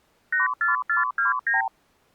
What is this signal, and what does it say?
Multi-frequency trunk signalling (R2, with the far end's replies), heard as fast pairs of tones, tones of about 140 ms. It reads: 84429